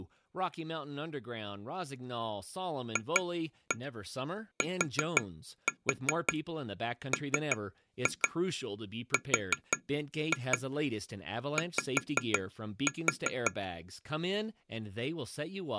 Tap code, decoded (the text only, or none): FTMRY